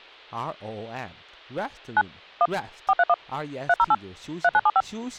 DTMF, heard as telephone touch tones, dialled by machine, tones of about 50 ms, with speech in Chinese. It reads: 9 1 431 308 3975